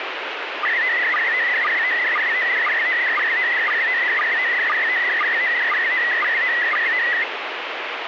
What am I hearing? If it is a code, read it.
SSTV (slow-scan television), PD 120, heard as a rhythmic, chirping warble, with radio static.